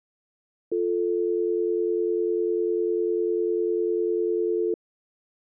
Telephone call progress tone (North American or UK plan), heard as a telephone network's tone, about 350, 440 Hz. Dial tone.